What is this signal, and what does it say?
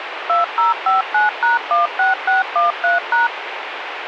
DTMF, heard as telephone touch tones, dialled by machine, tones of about 150 ms, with radio hiss. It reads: 2059#16613#